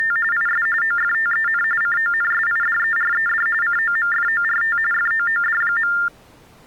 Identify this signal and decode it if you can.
TTY/TDD text telephone tones (45.45 baud Baudot), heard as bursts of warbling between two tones, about 400 Hz shift, 1600 Hz centre. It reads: … IS OFTEN CONSIDERED COMFORT FOOD.